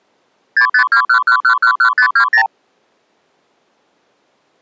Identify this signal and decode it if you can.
Multi-frequency trunk signalling (R2, with the far end's replies), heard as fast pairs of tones, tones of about 90 ms. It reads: 65211111520